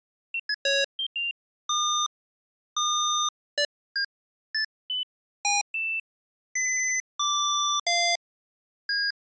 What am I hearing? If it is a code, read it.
Electronic bleeps of random pitch and length. There is no code.